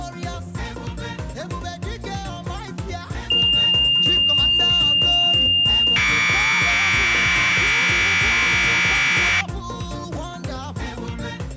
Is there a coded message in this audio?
Yes: Commodore tape loading (standard loader) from 3.3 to 9.4 s, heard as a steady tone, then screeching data.